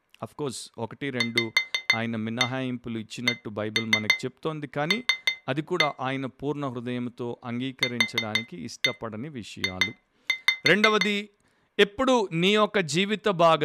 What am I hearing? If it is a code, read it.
Tap code, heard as taps on glass, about 6 knocks a second, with speech in Tamil. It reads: VCL QJ